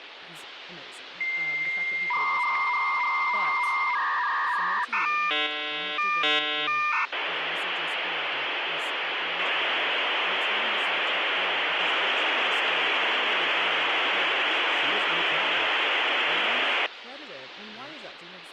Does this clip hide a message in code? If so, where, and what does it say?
Yes: dial-up modem handshake (V.34 or later) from 1.2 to 16.9 s, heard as a whistle, warbles, then hiss, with phone line noise and speech in English.